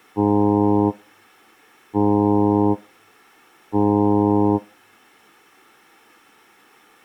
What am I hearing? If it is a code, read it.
Ship horn signal, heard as a ship's horn, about 100 Hz. 3 short. At sea: I am operating astern propulsion.